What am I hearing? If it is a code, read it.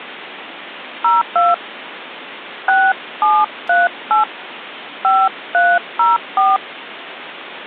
DTMF, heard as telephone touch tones, dialled by hand, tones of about 200 ms, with phone line noise. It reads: 02 6738 5304